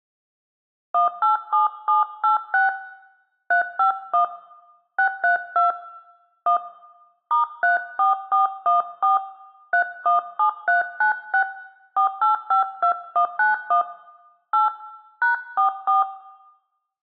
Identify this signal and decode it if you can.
DTMF, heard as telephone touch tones, dialled by hand, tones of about 120 ms, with room echo. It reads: 187786 351 632 1 *34414 317396 4852191 8 #44